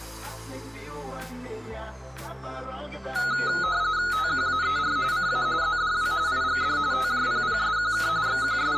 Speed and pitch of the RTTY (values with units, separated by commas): 45.45 baud, 170 Hz shift, 1360 Hz centre